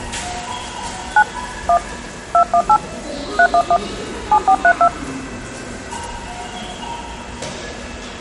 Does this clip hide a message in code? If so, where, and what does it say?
Yes: DTMF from 1.2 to 4.9 s, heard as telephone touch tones, dialled by hand, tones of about 70 ms, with the noise of a subway station. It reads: 9 1 218 311 7432